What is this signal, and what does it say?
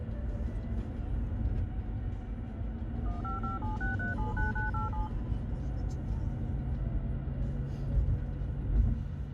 DTMF, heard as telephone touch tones, dialled by machine, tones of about 140 ms, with the noise inside a car. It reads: 15576379987